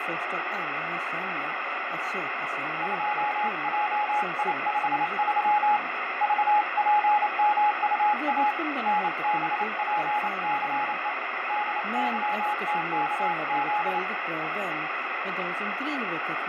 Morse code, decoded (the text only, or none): 2JI53 VPMUA NBPCE DYTKZ